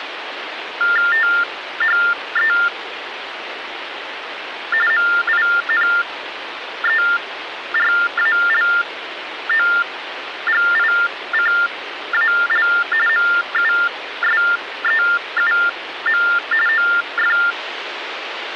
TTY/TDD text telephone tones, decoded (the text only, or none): THE MINERALOGICAL MUSEUM OF